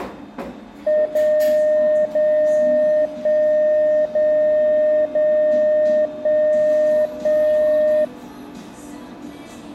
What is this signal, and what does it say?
Radio time signal (DCF77), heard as a tone whose level steps once a second, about 610 Hz, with the noise of a cafe. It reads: 0 0 1 0 0 1 1